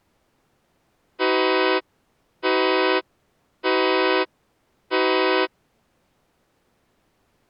Train horn signal, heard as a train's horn. 4 short. On North American railways: a request for a signal to be given or repeated.